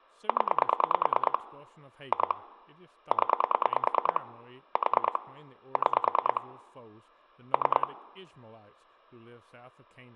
Pulse dialling, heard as clicks on a phone line, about 9 pulses a second, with room echo and speech in English. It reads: 0 2 0 4 6 3